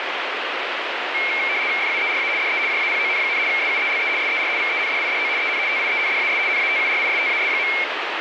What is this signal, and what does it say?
RTTY (75 baud, 170 Hz shift), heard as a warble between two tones, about 2250 Hz centre, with radio static. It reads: FUERA DE JAPON, SUELE SER VENDIDO EN TIENDAS NATURISTAS.